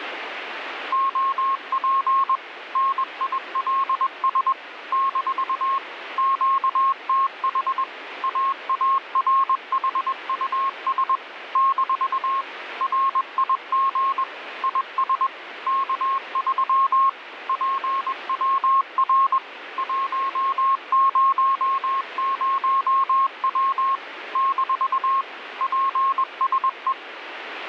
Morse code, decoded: OP NILS - QTH AARHUS - RIG IS K3 PWR 100W - PSE

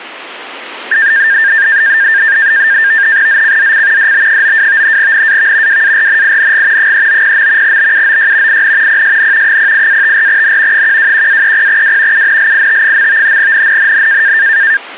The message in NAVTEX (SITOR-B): ZCZC DB92 NAV WARNING 390. BUOY IN PSN 08-54N 121-30W UNLIT. NNNN

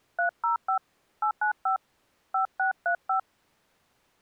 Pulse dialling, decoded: none

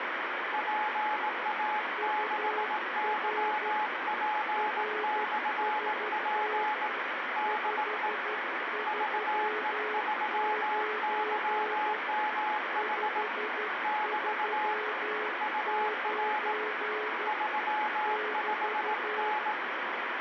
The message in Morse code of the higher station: PA6YP/P DE VE3YMH <BT> UR 35N

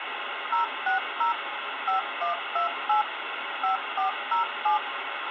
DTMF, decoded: 060 5128 5407

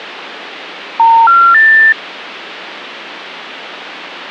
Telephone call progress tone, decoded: special information tone

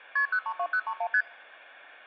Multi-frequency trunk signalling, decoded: KP 032031 ST

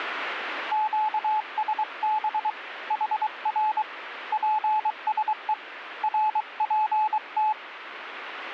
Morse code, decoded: QSB HR PSE RPT

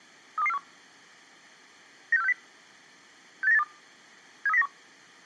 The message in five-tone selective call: 32241 96460 68982 73091

